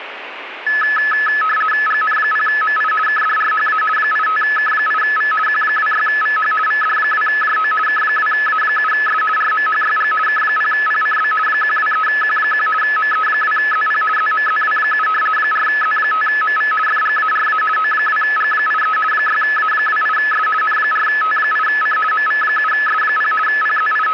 RTTY (50 baud, 450 Hz shift), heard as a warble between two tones, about 1500 Hz centre, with radio static. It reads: GN0MI KDRHA 85K8V Q26VH VD2JO K2A7S RMHYG K0PCB 123Q1 ME2ZP ZMZW7 4Z5MV FGARA O2G83 6A28S N4T8C MV7S0 …